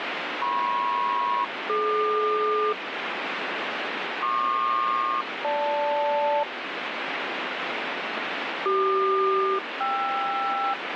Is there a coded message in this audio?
Yes: aircraft SELCAL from 0.4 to 10.7 s, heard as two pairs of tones, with radio static. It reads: MP-DQ PQ-GL CQ-KR